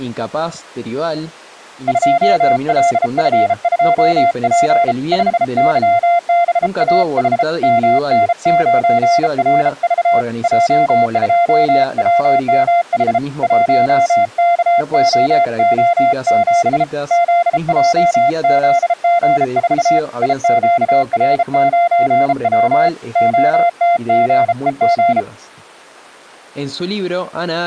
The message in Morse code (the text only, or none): 2LF2P 5YBAH MN9RV J2WMH 1KOO7 ZJZG4 IQR9W OTGEG